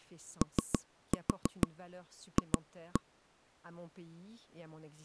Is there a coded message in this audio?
Yes: tap code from 0.4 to 3.0 s, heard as taps on a table, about 6 knocks a second, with speech in French. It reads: OF